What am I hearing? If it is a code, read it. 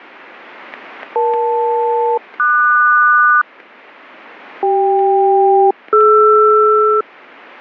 Aircraft SELCAL, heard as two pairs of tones, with static crashes. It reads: EL-QS CK-DR